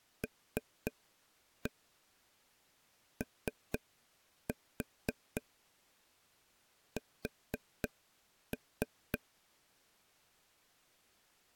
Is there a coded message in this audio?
Yes: tap code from 0.2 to 9.2 s, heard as taps on a table, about 4 knocks a second. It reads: LOS